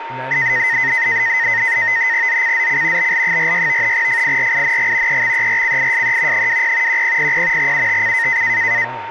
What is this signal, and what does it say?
NAVTEX (SITOR-B), 100 baud, 170 Hz shift, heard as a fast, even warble, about 1950 Hz centre, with radio static, a steady whistle near 920 Hz and speech in English. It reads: ZCZC BL46 FIRING EXERCISE 20 1000 UTC